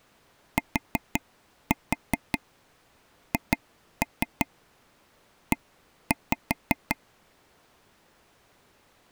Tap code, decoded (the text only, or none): THE